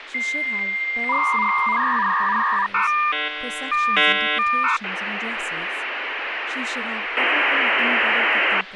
Dial-up modem handshake (V.34 or later), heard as a whistle, warbles, then hiss, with phone line noise and speech in English.